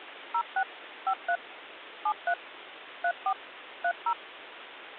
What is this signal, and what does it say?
DTMF, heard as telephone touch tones, dialled by machine, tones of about 70 ms, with phone line noise. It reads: 06 53 73 34 30